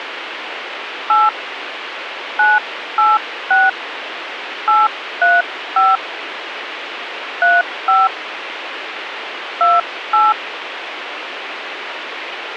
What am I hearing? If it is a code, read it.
DTMF, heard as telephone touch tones, dialled by hand, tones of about 190 ms, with radio hiss. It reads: 8 986 835 35 28